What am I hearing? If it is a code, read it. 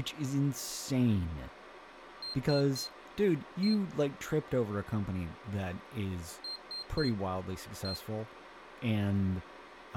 Beep code, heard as a piezo beeper, played twice, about 4200 Hz, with speech in English. 3-1.